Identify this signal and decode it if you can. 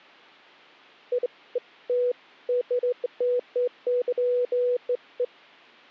Beeps of irregular length. There is no code.